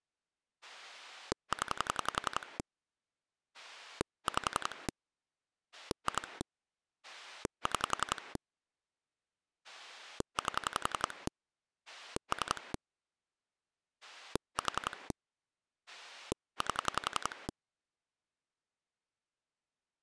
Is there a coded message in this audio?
Yes: pulse dialling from 0.6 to 17.5 s, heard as a rotary dial, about 11 pulses a second. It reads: 0 5 2 6 8 3 4 8